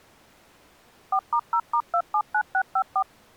DTMF, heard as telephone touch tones, dialled by machine, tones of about 70 ms. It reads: 4*0*279654